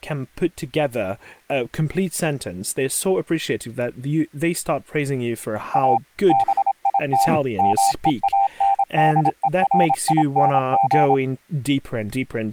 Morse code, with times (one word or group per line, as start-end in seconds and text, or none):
5.7-6.0 A
6.3-7.3 BIT
7.6-11.1 MEANDERING